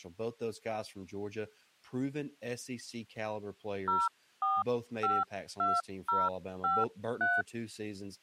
DTMF, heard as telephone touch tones, dialled by hand, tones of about 200 ms, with speech in English. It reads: 0452053